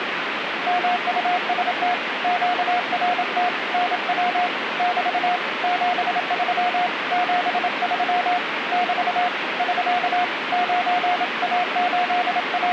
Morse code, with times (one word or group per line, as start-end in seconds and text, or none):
0.7-1.9 MUST
2.2-3.5 QRT
3.7-4.5 NW
4.8-5.4 <BT>
5.6-6.9 73
7.1-8.4 73
8.7-9.3 <BT>
9.6-10.2 <SK>
10.5-12.7 …